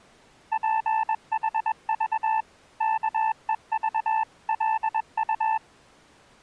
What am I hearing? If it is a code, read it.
Morse code (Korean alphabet), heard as a keyed tone, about 21 wpm, 880 Hz. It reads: 줄 알기